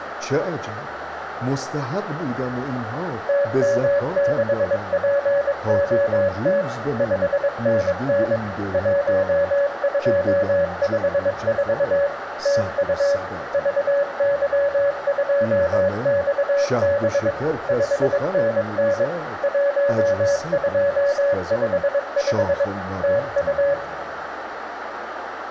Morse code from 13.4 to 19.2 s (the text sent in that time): VY2XB 5NN